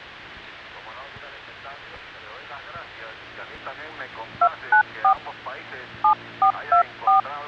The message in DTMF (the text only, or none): 294 7424